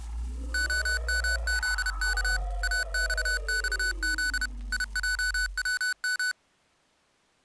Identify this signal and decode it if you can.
Morse code, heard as electronic beeps, machine-sent, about 31 wpm, 1490 Hz. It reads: OMZK AXXZ IJWM